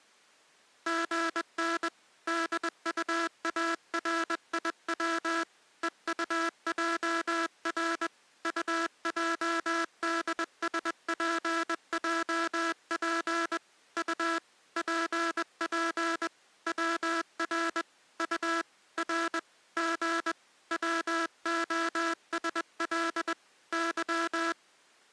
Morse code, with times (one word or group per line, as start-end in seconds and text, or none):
0.9-1.9 GN
2.3-5.4 DUARIW
5.8-8.1 EUJR
8.4-13.6 UJDSPJP
14.0-14.4 U
14.8-16.3 PP
16.7-17.8 WR
18.2-18.6 U
19.0-19.4 R
19.8-20.3 G
20.7-23.3 WOSL
23.7-24.5 Y